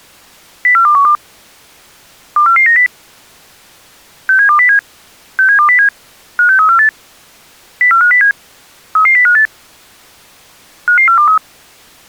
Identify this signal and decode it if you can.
Five-tone selective call (CCIR), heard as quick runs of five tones, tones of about 100 ms. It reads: 04212 24490 67207 67207 56348 04507 33058 55423